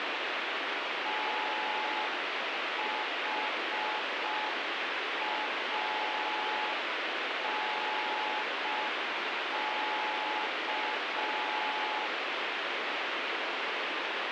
Morse code, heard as a keyed tone, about 5 wpm, 860 Hz, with heavy radio static. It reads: THANK